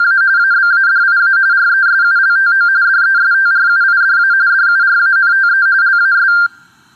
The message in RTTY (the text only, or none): … ABADIA RESULTO DESTRUIDA DURANTE LAS